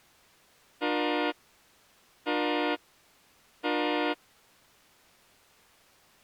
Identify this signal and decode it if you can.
Train horn signal, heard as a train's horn. 3 short. On North American railways: when stopped, the train will back up.